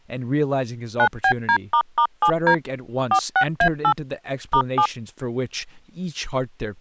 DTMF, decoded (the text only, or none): 9BD**7D 46A8 *7